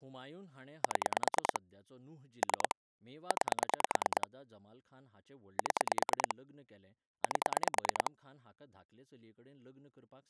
Pulse dialling, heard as clicks on a phone line, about 9 pulses a second, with speech in Goan Konkani. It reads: 7 3 9 7 8